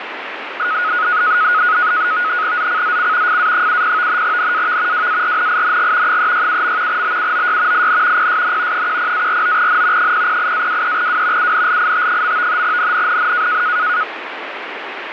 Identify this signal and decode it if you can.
NAVTEX (SITOR-B), 100 baud, 170 Hz shift, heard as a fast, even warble, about 1360 Hz centre, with radio static. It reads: ZCZC FA70 NAV WARNING 367. BUOY IN PSN 10-49N 008-23W UNLIT. NNNN